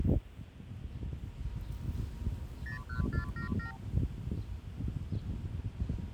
Multi-frequency trunk signalling (R2, with the far end's replies), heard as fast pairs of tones, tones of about 120 ms, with the noise of a residential street. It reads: 01477